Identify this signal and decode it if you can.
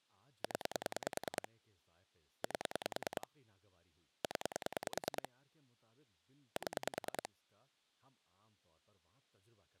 Pulse dialling, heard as clicks on a phone line, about 10 pulses a second, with speech in Urdu. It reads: 0 8 0 7